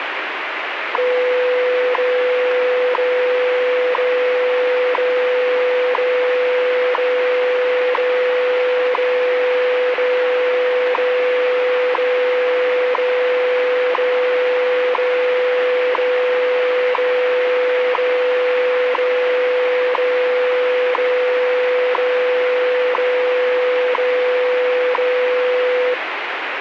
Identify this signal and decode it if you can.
Radio time signal (WWV, Colorado), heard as ticks, one a second, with radio static.